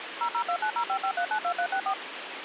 DTMF, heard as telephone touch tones, dialled by machine, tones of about 80 ms, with phone line noise. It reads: 0029055392364